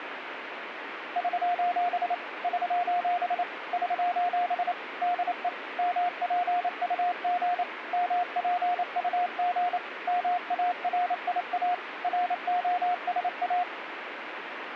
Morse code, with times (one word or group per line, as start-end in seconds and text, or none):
1.2-2.1 <SOS>
2.4-3.4 <SOS>
3.7-4.7 <SOS>
5.0-5.5 DE
5.8-7.6 MPUG
7.9-9.8 MPUG
10.1-11.7 MARIA
12.0-13.6 ROSA